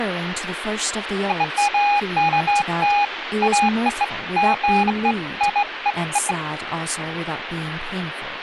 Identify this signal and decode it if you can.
Beeps of irregular length, with phone line noise and speech in English. There is no code.